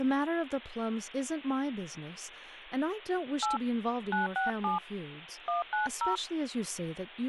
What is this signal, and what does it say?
DTMF, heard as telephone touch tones, dialled by hand, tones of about 140 ms, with hum and speech in English. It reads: 8 967 190